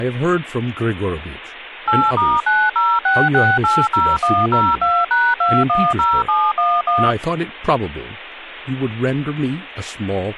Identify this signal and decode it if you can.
DTMF, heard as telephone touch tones, dialled by machine, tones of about 240 ms, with speech in English. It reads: 8*906680102#210711